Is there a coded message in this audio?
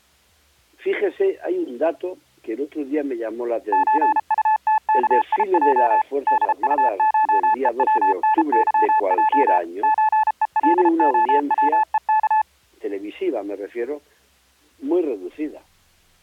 Yes: Morse code (Russian alphabet) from 3.7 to 12.5 s, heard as a keyed tone, machine-sent, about 33 wpm, 870 Hz. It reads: ЧУТКИЙ ДУШЕВНЫЙ ЧЕЛОВЕК